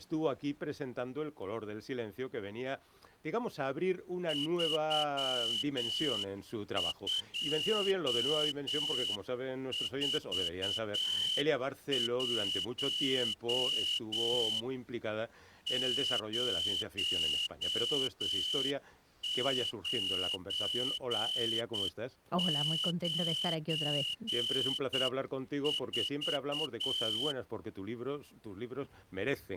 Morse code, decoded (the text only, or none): 3241 0994